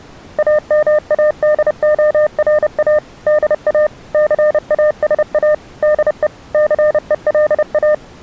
Morse code, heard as a keyed tone, machine-sent, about 30 wpm, 600 Hz. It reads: AMADORA DA CASA DE CELA